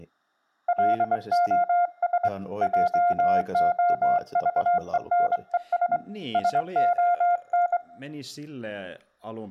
Morse code, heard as a keyed tone, hand-sent with a straight key, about 23 wpm, 700 Hz, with speech in Finnish. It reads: LOS JOVENES SON